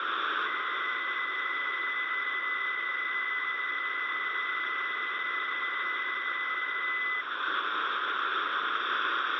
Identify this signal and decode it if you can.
PSK63 (62.5 baud), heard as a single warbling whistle, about 2000 Hz, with radio static.